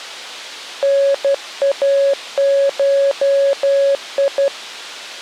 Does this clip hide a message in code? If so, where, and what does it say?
Yes: Morse code (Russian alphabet) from 0.8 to 4.5 s, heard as a keyed tone, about 12 wpm, 560 Hz. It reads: НАШИ